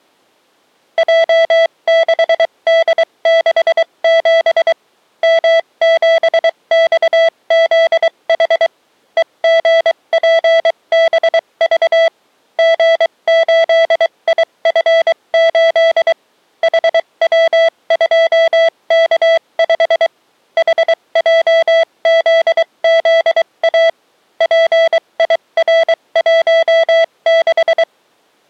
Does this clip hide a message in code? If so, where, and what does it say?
Yes: Morse code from 0.9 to 27.9 s, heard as a keyed tone, machine-sent, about 23 wpm, spaced as for 20 wpm, 660 Hz. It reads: J6D67 M7XZH EGPBV G8IF8 HW2K5 HJZZA PIR16